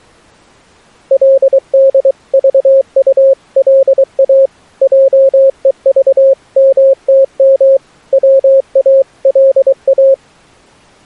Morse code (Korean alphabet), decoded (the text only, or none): 그리고 할멈 보고